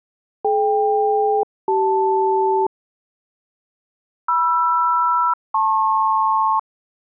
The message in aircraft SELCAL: DK-CL MR-LP

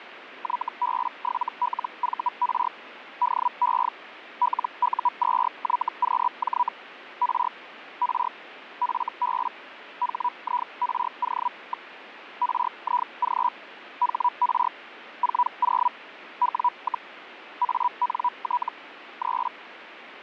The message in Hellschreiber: YB7LVR DE LU2YQJ R R FB HIRO. RIG HR 40 W, ANT 3

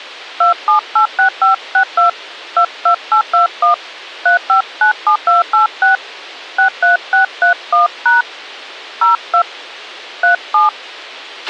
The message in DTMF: 2786562 22821 3597286 63631# 02 37

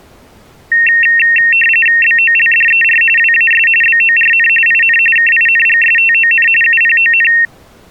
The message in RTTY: BOLDER WAS BORN IN KINGSTON UPON

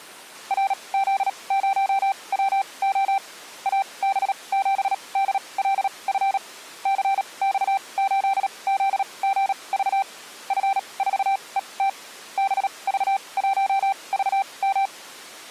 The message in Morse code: RZ0WO AB7DLF CX8ZGV F4ET BV1VM

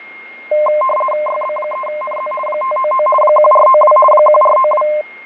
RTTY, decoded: YB3NZ 599 1492 1492

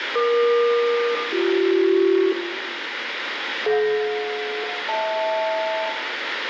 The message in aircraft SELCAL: EQ-BC DJ-HL

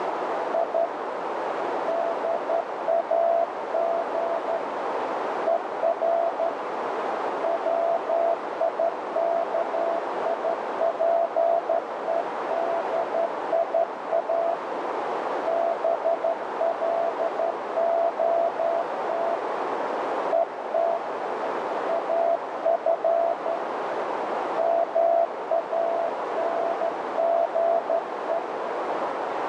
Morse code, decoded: I DAG ER WIKIPEDIA BLOT ET AF MANGE

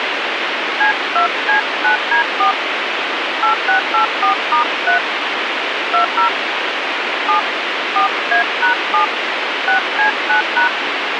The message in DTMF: C2C9D4 8684*3 20 7 4A#7 6C9#

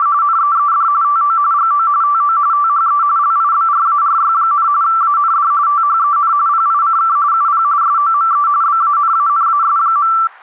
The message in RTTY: … NEED TO GO TO THE LIBRARY, AND THEN PICK UP SOME BANANAS.

